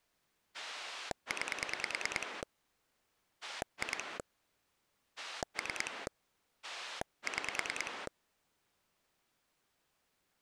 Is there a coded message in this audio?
Yes: pulse dialling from 0.5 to 8.1 s, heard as a rotary dial, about 9 pulses a second. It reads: 9 2 3 6